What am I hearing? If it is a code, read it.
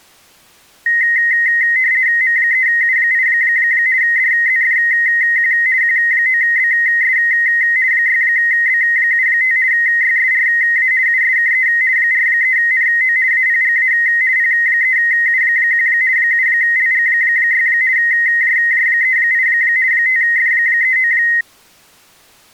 RTTY (50 baud, 170 Hz shift), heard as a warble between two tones, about 1950 Hz centre. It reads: M3U8 DZFQ Q9BS 6B75 YSRA USKE 43NO APGA P3U1 7LG6 JJ38 5F39